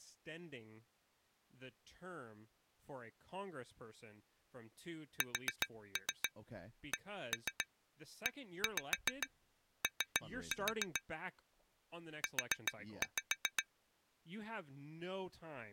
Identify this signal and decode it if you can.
Tap code, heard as taps on glass, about 7 knocks a second, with speech in English. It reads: SCEO U